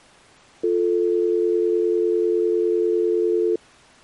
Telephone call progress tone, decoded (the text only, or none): dial tone